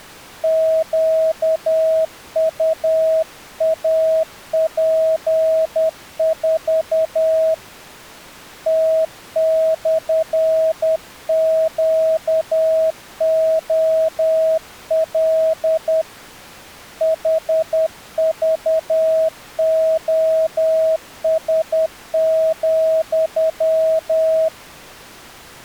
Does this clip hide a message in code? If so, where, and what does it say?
Yes: Morse code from 0.4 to 24.5 s, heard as a keyed tone, hand-sent with a paddle, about 10 wpm, 640 Hz. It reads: QUAP4 T/QOL HVOS,